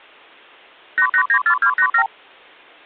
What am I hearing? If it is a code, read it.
Multi-frequency trunk signalling (R2, with the far end's replies), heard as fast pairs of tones, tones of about 80 ms. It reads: 8894287